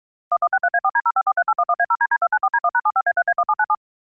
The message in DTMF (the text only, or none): 1163A4D0543811A0DD294D1#75A3A1797